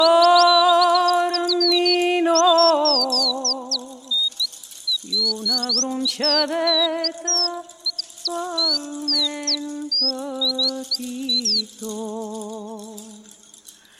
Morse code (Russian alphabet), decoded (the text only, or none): none